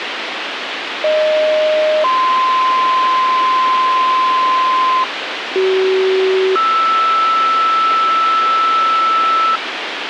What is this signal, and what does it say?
Two-tone page, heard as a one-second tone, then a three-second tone, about 620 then 1040 Hz, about 380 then 1320 Hz, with radio hiss and a squelch burst at the end.